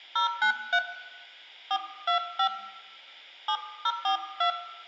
DTMF, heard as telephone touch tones, dialled by hand, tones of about 90 ms, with room echo. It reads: 093 425 7042